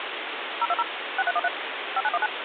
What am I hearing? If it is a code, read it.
DTMF, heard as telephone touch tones, dialled by machine, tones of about 40 ms, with phone line noise. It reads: 020 6313 5919